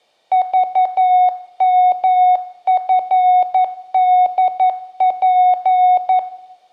Morse code, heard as a keyed tone, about 11 wpm, 730 Hz, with room echo. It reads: VMFDP